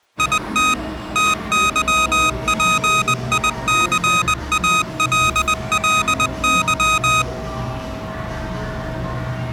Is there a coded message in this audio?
Yes: Morse code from 0.1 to 7.3 s, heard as electronic beeps, machine-sent, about 20 wpm, 1250 Hz, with the noise of a cafe. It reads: IT TYPICALLY